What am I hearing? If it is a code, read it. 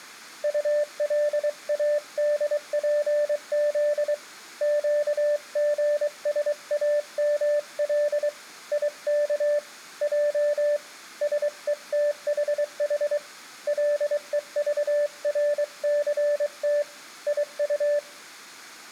Morse code, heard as a keyed tone, hand-sent with a paddle, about 23 wpm, 590 Hz, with room echo. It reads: ULADPZ QGSAML IK J SETHH LEVRCT IU